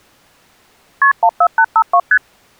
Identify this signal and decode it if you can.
Multi-frequency trunk signalling (R1, as on North American trunks), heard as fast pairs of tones, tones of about 70 ms. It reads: KP 14852 ST